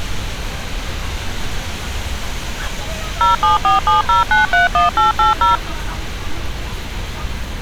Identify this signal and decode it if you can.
DTMF, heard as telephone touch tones, dialled by machine, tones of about 140 ms, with street noise. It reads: 07470931880